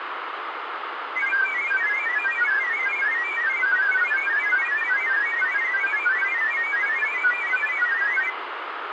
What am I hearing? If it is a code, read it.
Multi-tone FSK (Olivia or MFSK type), about 1000 Hz wide, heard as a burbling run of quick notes, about 31.25 baud, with radio static.